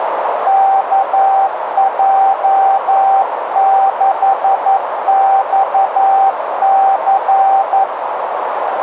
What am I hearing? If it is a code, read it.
Morse code, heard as a keyed tone, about 11 wpm, 780 Hz, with radio static and a narrow filter. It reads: KJ6XC